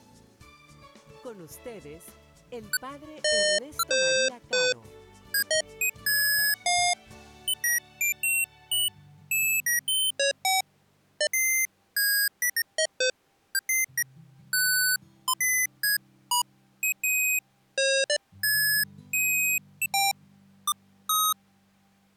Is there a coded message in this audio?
No, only electronic bleeps of random pitch and length.